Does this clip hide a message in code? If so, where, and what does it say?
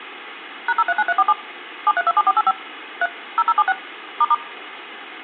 Yes: DTMF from 0.7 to 4.3 s, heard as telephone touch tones, dialled by machine, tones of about 40 ms. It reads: #039347 7327485 3 0076 **